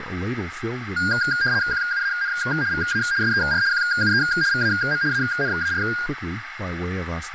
RTTY (75 baud, 170 Hz shift), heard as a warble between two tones, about 1500 Hz centre, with radio static, a narrow filter and speech in English. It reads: QUAN VA SER QUE VAM ANAR